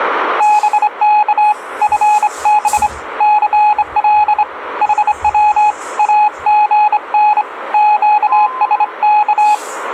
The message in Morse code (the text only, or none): BK FB CL HW AGN QSK